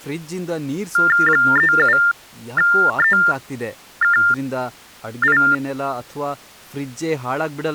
TTY/TDD text telephone tones (45.45 baud Baudot), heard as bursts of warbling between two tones, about 400 Hz shift, 1600 Hz centre, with speech in Kannada. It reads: 37EKI